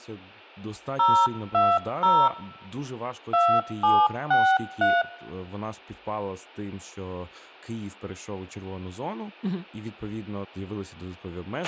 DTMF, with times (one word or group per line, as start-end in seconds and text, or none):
1.0-2.3 020
3.3-5.0 2763